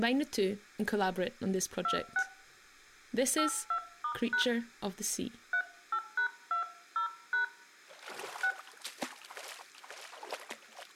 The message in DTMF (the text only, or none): 26 82*# 38#20# 6